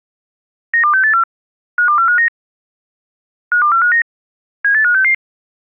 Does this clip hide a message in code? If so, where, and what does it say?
Yes: five-tone selective call (CCIR) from 0.7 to 5.1 s, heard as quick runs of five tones, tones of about 100 ms. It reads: 92684 52459 52459 78566